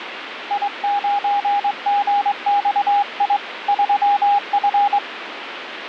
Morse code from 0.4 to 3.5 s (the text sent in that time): I9GXI